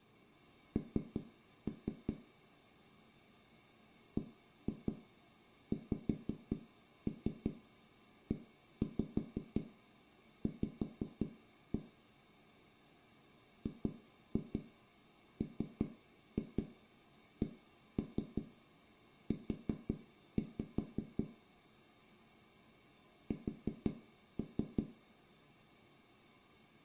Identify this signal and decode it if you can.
Tap code, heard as knocks on a wall, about 5 knocks a second, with room echo. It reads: N BXEV GMCU S